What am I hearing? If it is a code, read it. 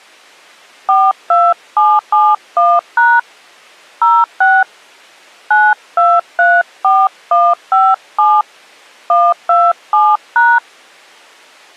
DTMF, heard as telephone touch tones, dialled by hand, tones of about 230 ms. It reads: 42771# 06 9234157 127#